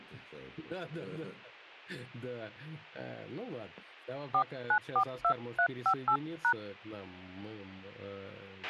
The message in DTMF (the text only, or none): 4942358#